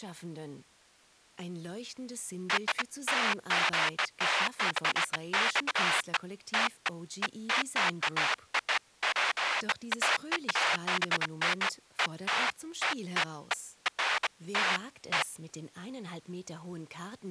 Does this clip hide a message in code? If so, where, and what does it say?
No, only bursts of noise.